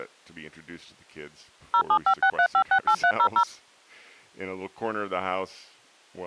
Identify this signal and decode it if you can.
DTMF, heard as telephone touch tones, dialled by machine, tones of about 80 ms, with speech in English. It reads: 07563568300